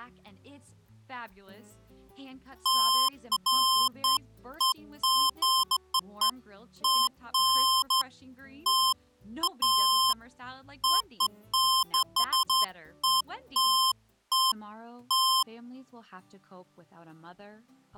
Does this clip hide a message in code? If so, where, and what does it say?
No, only beeps of irregular length.